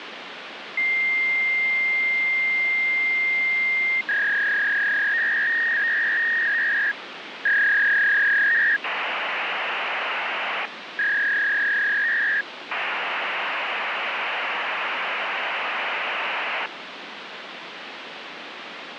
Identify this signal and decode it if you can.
Fax machine handshake, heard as a long tone, a warble and hiss, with phone line noise.